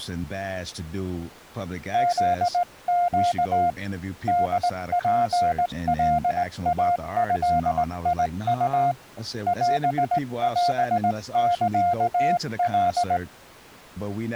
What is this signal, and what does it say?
Morse code (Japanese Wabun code), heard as a keyed tone, hand-sent with a straight key, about 18 wpm, 700 Hz, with speech in English. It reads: フネ ホツカイドウ オオサカ